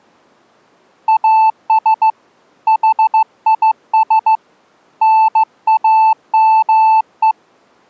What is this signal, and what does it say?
Morse code, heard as a keyed tone, hand-sent with a straight key, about 15 wpm, 880 Hz. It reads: AS HIS NAME